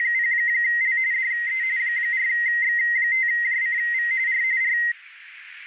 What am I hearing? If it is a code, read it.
RTTY (45.45 baud, 170 Hz shift), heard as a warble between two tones, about 2000 Hz centre, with radio static. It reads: … DE 4X5JCV R R